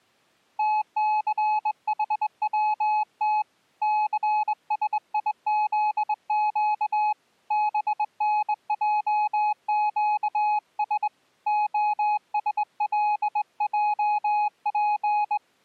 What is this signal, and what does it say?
Morse code (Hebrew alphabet), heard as a keyed tone, hand-sent with a straight key, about 21 wpm, 840 Hz. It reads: תסחצת סשיזק בנעקש השלעף